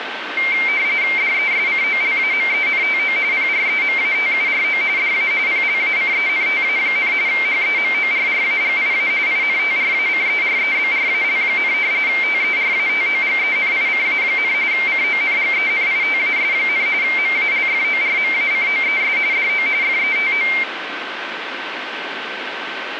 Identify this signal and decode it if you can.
RTTY (45.45 baud, 170 Hz shift), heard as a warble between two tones, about 2200 Hz centre, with radio static and a steady whistle near 1540 Hz. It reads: DESCOLAMENTO PREMATURO DA PLACENTA, HEMORRAGIA INTRACEREBRAL, TERATOGENICA, CONGENITAS, MALFORMACOES DO FETO